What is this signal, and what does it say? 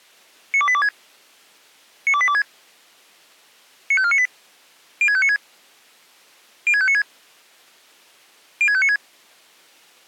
Five-tone selective call (ZVEI), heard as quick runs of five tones, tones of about 70 ms. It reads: 92826 92826 95498 06596 06596 06596